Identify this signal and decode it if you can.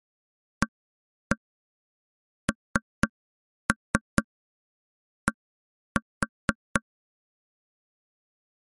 Tap code, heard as taps on a table, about 4 knocks a second. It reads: AND